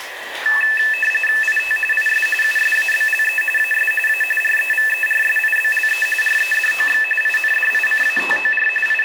RTTY (45.45 baud, 850 Hz shift), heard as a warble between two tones, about 2200 Hz centre, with radio static, room echo and the noise of a restroom. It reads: IT IS USABLE AS A REVERSIBLE REDOX INDICATOR …